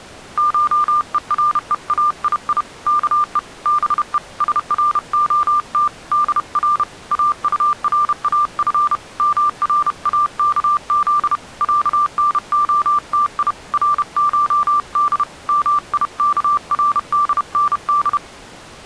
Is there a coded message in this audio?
Yes: Morse code (Persian alphabet) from 0.3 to 18.2 s, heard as a keyed tone, hand-sent with a paddle, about 31 wpm, 1180 Hz. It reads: شهرهایی که به سرعت در اطراف مراکز صنعتی رشد میکردند